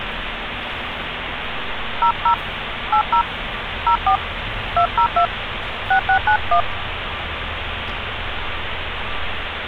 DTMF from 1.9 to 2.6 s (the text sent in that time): 00